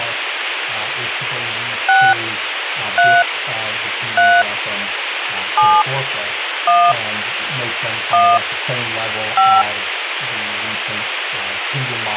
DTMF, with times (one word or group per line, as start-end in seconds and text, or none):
1.9-2.1 6
3.0-3.2 3
4.2-4.4 3
5.6-5.8 7
6.7-6.9 1
8.1-8.4 1
9.4-9.6 5